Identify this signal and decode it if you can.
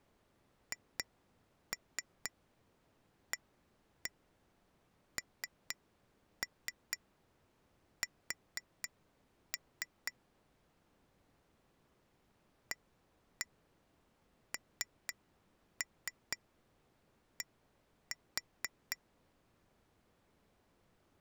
Tap code, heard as taps on glass, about 4 knocks a second. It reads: HANS AND